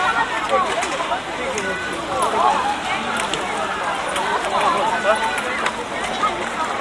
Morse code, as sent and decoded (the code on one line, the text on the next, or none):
none